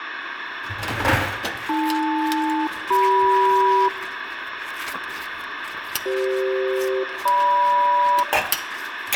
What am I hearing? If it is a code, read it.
Aircraft SELCAL, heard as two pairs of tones, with radio hiss and kitchen noise. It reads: AL-CM CF-GM